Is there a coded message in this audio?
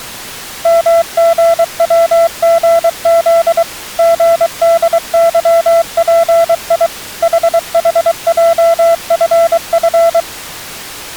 Yes: Morse code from 0.6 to 10.3 s, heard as a keyed tone, machine-sent, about 23 wpm, 670 Hz. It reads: MGWGZ GDYPI HHJFF